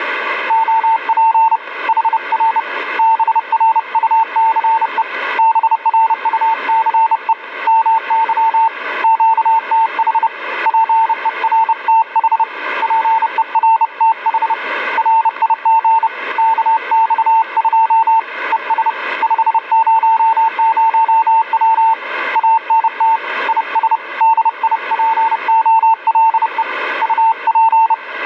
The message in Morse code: OP HR BRUCE BRUCE MY QTH PERTH PERTH RIG KX2 ES 500W ANT IS DIPOLE UP

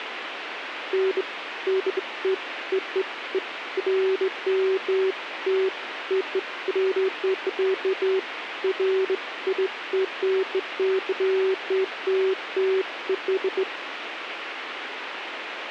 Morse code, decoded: none

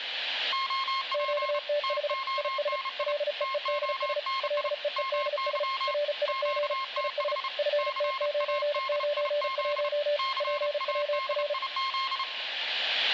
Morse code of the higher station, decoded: OP TONI TONI MY QTH CADIZ CADIZ

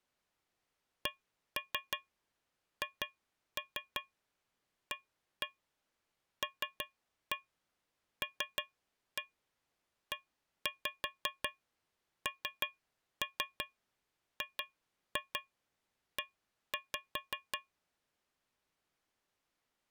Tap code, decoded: CHALLENGE

